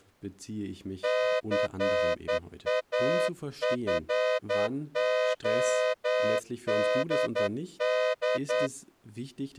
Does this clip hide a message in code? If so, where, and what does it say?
Yes: Morse code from 1.0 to 8.7 s, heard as a horn, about 10 wpm, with speech in German. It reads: CAFODD